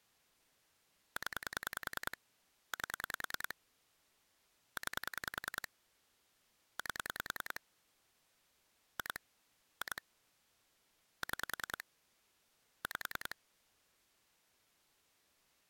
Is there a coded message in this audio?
Yes: pulse dialling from 1.2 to 13.3 s, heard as clicks on a phone line, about 10 pulses a second. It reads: 0 8 9 8 2 2 6 5